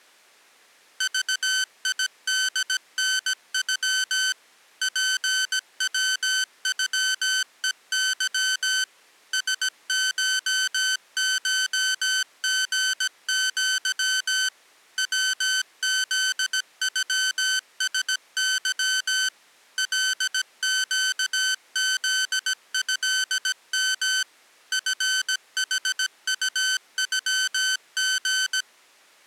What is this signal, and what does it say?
Morse code (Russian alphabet), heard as electronic beeps, machine-sent, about 17 wpm, 1550 Hz. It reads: ЖИДНЮ ПВЮЕЫ СШШГЪ ВЗЮСЫ ЛЩЗЭМ ФХУЮГ